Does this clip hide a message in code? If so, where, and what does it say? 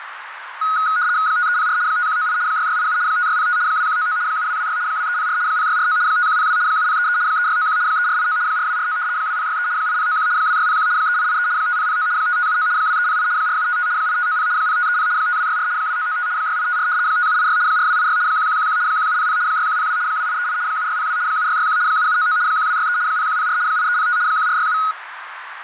Yes: RTTY (75 baud, 170 Hz shift) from 0.6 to 24.9 s, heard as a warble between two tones, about 1360 Hz centre, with radio static and a narrow filter. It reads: 5304 5198 6687 5605 2199 7226 2304 0649 5102 7033 3691 3489 4249 2063 8091 2601 3883 5009 5579 2308 4755 8590 0530 5264 2995 6854 5786 4286 1111 1700 6102 2838 7602 7661 7799 1263 0104 8305 1467